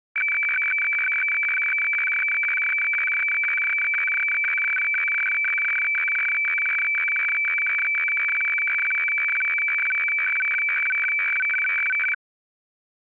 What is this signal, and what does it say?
Weather fax (radiofax), 120 lines a minute, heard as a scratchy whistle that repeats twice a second.